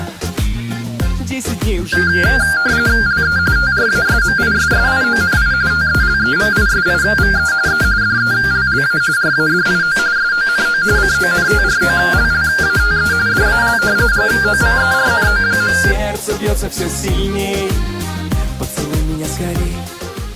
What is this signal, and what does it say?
RTTY (45.45 baud, 170 Hz shift), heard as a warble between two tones, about 1500 Hz centre. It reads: LE TRASMISSIONI TELEVISIVE E DELLA RADIO SONO CONTROLLATE DAL GOVERNO.